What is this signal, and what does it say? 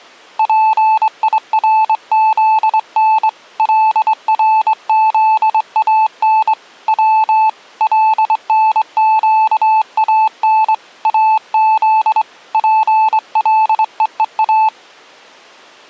Morse code (Persian alphabet), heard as a keyed tone, hand-sent with a straight key, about 23 wpm, 870 Hz. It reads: پیرزن لرزان و لنگان از پلهها